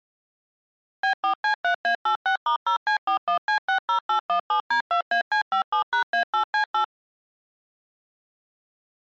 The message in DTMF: B4C3A86*0C41C60817D2AC57#A8C8

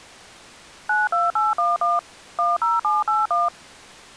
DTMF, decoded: 92811 10781

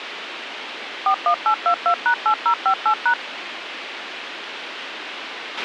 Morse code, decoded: none

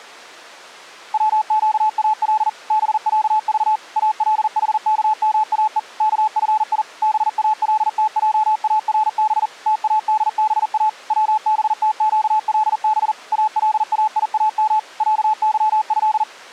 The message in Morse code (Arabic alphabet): وقال بعض الحكماء كفي بالتجارب تادبا وبتقلب الايام عظه

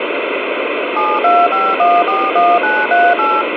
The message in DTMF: 725141938

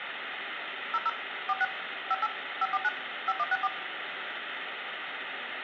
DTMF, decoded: 00 46 58 549 5164

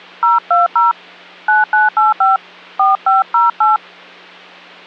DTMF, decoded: 020 9985 4508

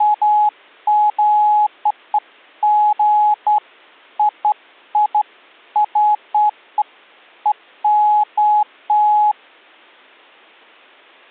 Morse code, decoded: none

